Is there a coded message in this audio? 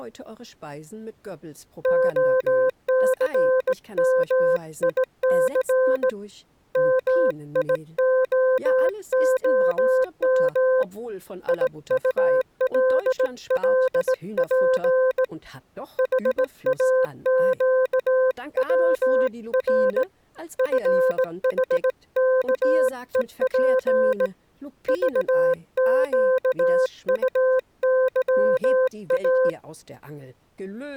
Yes: Morse code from 1.8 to 29.6 s, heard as a keyed tone, hand-sent with a straight key, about 18 wpm, 520 Hz. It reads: OCMIC MIOOM IULLP HAQWR FHKEP VQUYA